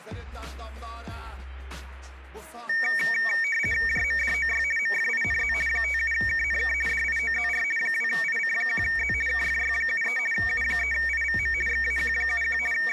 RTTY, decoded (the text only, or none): JMDOY MFINZ 57KNK DIOZR 2IC1Z KFY73 U3IVM XAQ71 …